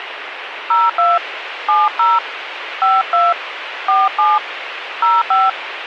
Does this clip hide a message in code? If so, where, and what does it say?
Yes: DTMF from 0.7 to 5.5 s, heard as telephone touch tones, dialled by hand, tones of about 200 ms, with radio hiss. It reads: 02 70 52 47 05